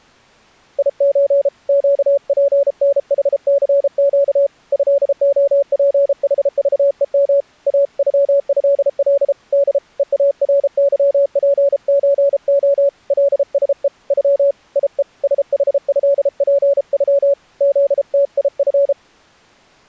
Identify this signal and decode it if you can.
Morse code (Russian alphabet), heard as a keyed tone, hand-sent with a paddle, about 33 wpm, 560 Hz. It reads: ИЧ ЩПНХЦЩ ЭОПХЖЕМ АЮЭЛ Д ЕАРЫПЧО ЛСЕ Ю ИЕ СХЭПЮ ЗТИФ